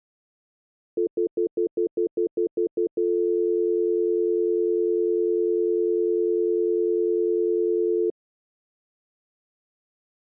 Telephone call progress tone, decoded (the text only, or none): stutter dial tone